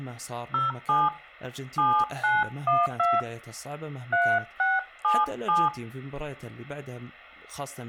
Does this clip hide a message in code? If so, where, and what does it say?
Yes: DTMF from 0.5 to 5.7 s, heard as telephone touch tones, dialled by hand, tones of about 200 ms, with speech in Arabic. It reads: 07 7912 3677